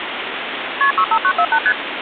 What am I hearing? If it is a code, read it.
Multi-frequency trunk signalling (R1, as on North American trunks), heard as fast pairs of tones, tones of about 70 ms, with phone line noise. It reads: KP 65948 ST